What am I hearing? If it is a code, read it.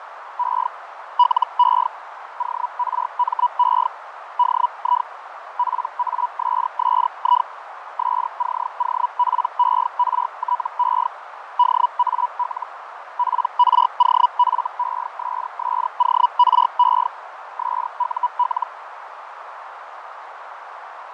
Hellschreiber (Feld-Hell, 122.5 baud), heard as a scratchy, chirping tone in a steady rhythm, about 980 Hz, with radio static, fading and a narrow filter. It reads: E LE ORME DI PASSI SCOPERTE DAL PROFESSORE SUL